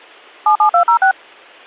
DTMF, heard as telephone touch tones, dialled by machine, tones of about 100 ms. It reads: 77206